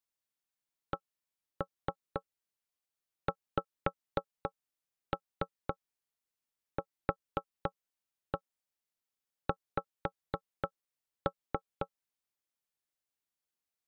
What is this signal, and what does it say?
Tap code, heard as knocks on wood, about 4 knocks a second. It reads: CXQX